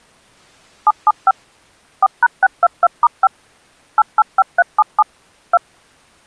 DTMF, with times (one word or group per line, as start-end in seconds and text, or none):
0.9-1.3 775
2.0-3.3 4#622*5
4.0-5.0 885377
5.5-5.6 2